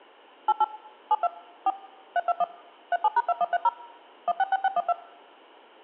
DTMF, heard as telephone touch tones, dialled by machine, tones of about 40 ms. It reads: 88 72 4 321 37#2130 166612